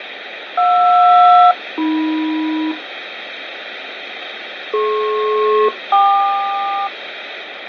Aircraft SELCAL, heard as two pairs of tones, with radio static and fading. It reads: JR-AM DP-KQ